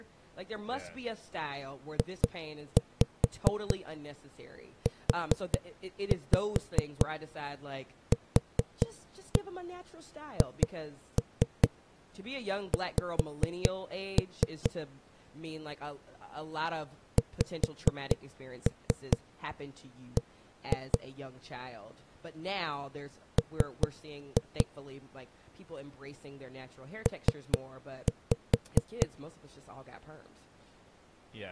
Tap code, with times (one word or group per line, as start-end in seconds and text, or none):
2.0-14.7 JUQHX
17.2-21.0 XB
23.4-24.7 M
27.1-29.1 P